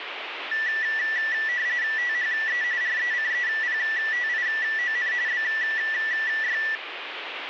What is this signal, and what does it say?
RTTY (45.45 baud, 170 Hz shift), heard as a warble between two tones, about 1850 Hz centre, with radio static. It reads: THE RECEPTION BY